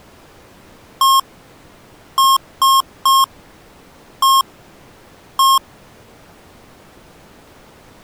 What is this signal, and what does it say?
Beep code, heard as beeps from a small speaker, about 1080 Hz. 1-3-1-1. In Phoenix BIOS tables: memory refresh test failure.